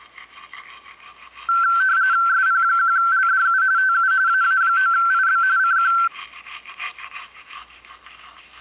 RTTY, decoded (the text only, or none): SP1LDU TU AA9IB CQ